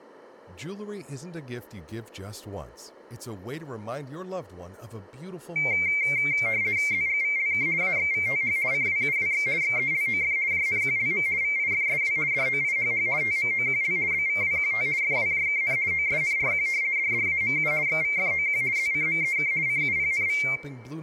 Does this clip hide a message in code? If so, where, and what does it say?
Yes: RTTY (50 baud, 170 Hz shift) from 5.6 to 20.6 s, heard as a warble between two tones, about 2200 Hz centre, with room echo and speech in English. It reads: ZGVLK AXVTH CWUWX XELOF JNQLM VIFSW DOIHH TMOQL BVWQT FWJKN OSNRQ DDAMU XVFOQ ZCMEK CUPNV